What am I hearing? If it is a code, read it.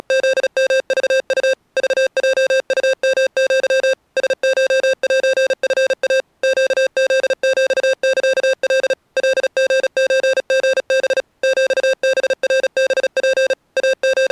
Morse code (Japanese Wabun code), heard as electronic beeps, machine-sent, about 36 wpm, 530 Hz. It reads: … クヲウヨア ラコセチイ ネフヒサカ カリソリハ ヒハナハツ …